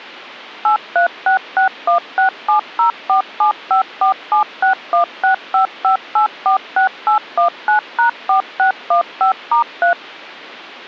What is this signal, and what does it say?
DTMF, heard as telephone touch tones, dialled by machine, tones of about 110 ms. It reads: 836616704754761655846819#4615*3